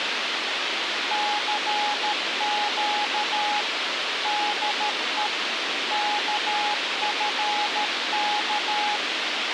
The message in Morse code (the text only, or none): CQ DE KFK